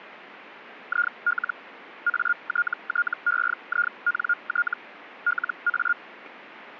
Hellschreiber (Feld-Hell, 122.5 baud), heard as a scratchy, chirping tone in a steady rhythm, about 1420 Hz. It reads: IL ATTEINT LA